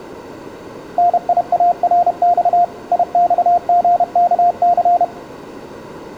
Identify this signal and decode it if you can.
Morse code (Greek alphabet), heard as a keyed tone, machine-sent, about 31 wpm, 700 Hz, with room echo. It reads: ΝΙΑΡΞ ΙΞΓΚΘ